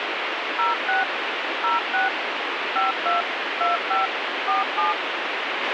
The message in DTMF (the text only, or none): 06 06 52 25 47